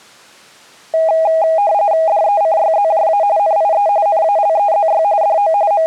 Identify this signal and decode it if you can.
RTTY (45.45 baud, 170 Hz shift), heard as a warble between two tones, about 730 Hz centre. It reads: DECYZJA NIE NALEZY DO …